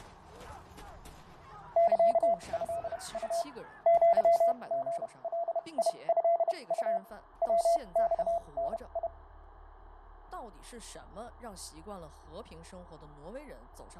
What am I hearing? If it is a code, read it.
Morse code (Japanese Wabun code), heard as a keyed tone, machine-sent, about 31 wpm, spaced as for 25 wpm, 680 Hz, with fading. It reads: サトウ アリガトウ ヤマダ